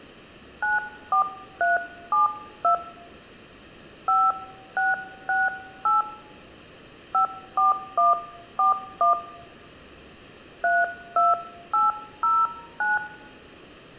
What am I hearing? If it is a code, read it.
DTMF, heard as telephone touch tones, dialled by hand, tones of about 160 ms. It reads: 94372 5668 54141 32809